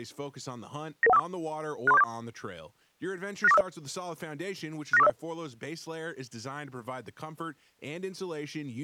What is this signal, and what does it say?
Five-tone selective call (EIA), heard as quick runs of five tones, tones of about 30 ms, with speech in English. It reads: 99154 63474 69450 69450